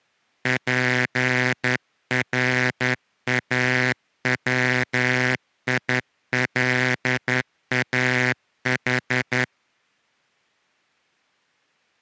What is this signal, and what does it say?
Morse code (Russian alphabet), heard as a buzzer, hand-sent with a straight key, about 11 wpm. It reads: ПРАВИЛАХ